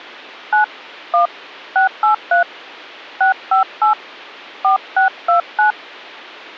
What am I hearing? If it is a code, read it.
DTMF, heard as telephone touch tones, dialled by hand, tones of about 120 ms. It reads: 9 1 683 658 4629